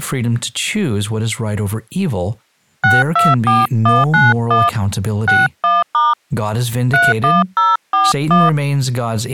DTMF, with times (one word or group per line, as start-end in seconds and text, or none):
2.8-4.7 624191
5.3-6.1 61*
6.9-8.5 31041